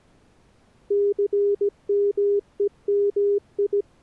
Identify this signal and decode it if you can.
Morse code, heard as a keyed tone, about 17 wpm, 400 Hz. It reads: CMEMI